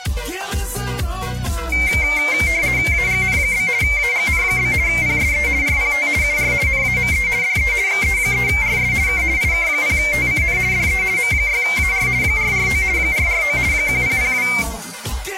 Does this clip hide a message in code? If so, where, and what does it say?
Yes: RTTY (50 baud, 170 Hz shift) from 1.7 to 14.6 s, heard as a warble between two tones, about 2200 Hz centre. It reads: AGN? AGN? PSE RPT UR NAME DE XE3RS K IK0TCN DE M6AR 449 449 1002